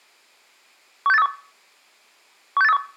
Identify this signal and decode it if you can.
Five-tone selective call (EEA), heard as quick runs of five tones, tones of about 40 ms. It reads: 16831 16831